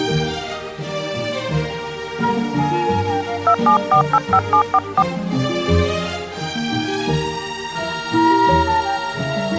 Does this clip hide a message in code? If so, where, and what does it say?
Yes: DTMF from 3.5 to 5.0 s, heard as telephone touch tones, dialled by hand, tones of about 90 ms. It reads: 27485744